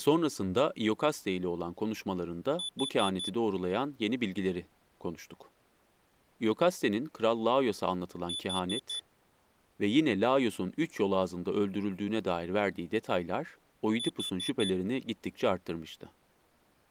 Alarm pattern, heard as an alarm's beeps, played three times, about 3500 Hz, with speech in Turkish. Temporal four. Carbon monoxide.